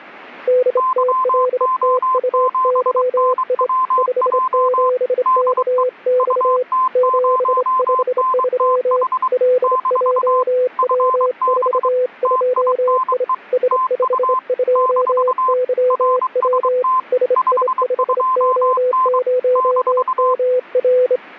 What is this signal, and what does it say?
Morse code, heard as two keyed tones. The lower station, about 27 wpm, 500 Hz: DTLTUYI 57KX 753 LJW42I S52YW SI5O0MR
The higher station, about 23 wpm, 1040 Hz: YO7NWJ DE UT0NTH - FB TINE TU - RST 52N -